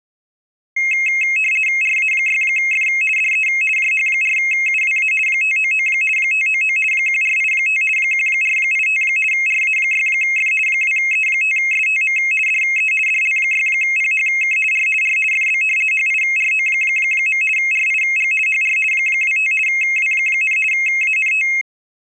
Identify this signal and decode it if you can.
RTTY (50 baud, 450 Hz shift), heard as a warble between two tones, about 2350 Hz centre. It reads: RA6F DE JH4UWA 599 599 1485 1485 RA6F 2E5STM DE DL6PHK R R FB HIRO. RIG HR 25 W, ANT